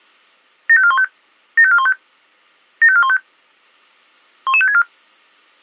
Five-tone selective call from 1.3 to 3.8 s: 75415 75415

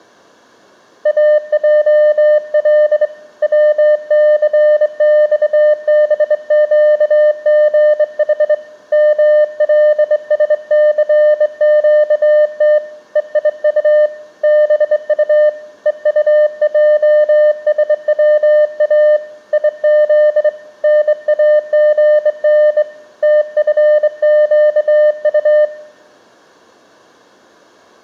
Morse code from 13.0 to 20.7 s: EIU BU EUJSWA IZ

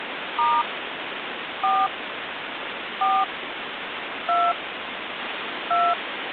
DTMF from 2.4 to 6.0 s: 4 2 2

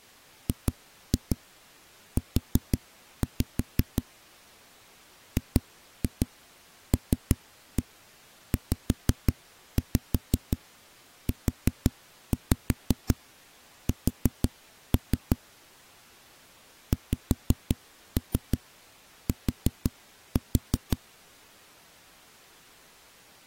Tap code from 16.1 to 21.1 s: XT

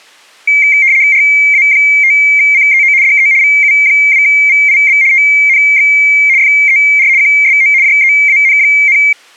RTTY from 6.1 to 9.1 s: FER QSO JEAN,

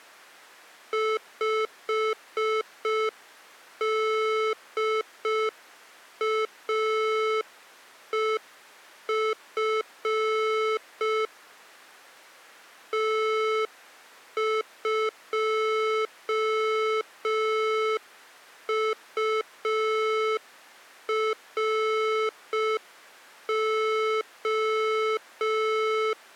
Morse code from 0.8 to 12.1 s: 5DAEF

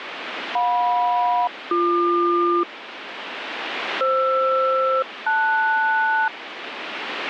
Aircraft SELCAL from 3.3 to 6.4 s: FR-LS

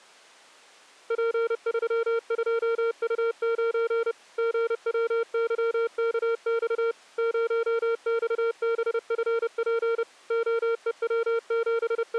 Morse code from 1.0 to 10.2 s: P32U9 GWYKX 0XBFP

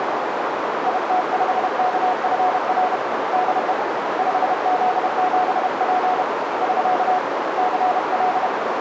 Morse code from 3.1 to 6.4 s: DE 5Z7P

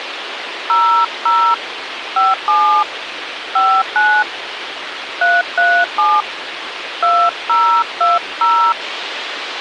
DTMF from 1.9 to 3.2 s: 57

